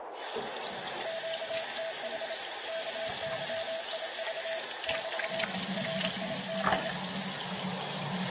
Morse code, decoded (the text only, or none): QTH KYIV <BT> RIG